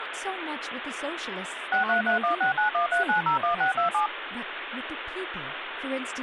DTMF, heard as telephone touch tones, dialled by machine, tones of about 120 ms, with phone line noise and speech in English. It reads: 63316913901627